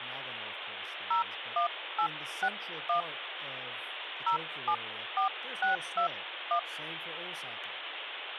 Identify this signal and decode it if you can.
DTMF, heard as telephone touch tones, dialled by hand, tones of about 100 ms, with phone line noise and speech in English. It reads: 01861 074621